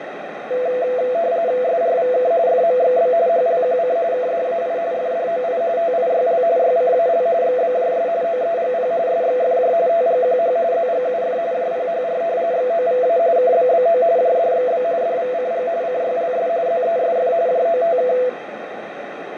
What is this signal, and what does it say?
RTTY (45.45 baud, 170 Hz shift), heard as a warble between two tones, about 590 Hz centre, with radio static and a narrow filter. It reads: SRVK FMXB HLQC KDAI FDOI TIYL YCAL XBJS OEGP SXFJ TGQH ZGUF JPHR XOVA KBBO JDXB DVCG CYLS ZESF JOTK